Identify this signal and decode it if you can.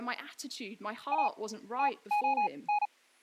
Morse code, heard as a keyed tone, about 37 wpm, spaced as for 25 wpm, 830 Hz, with speech in English. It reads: A TON